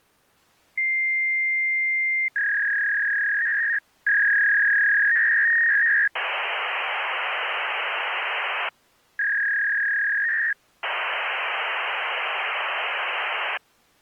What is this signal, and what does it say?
Fax machine handshake, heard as a long tone, a warble and hiss.